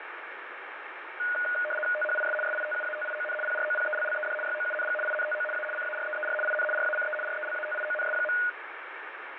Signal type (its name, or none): RTTY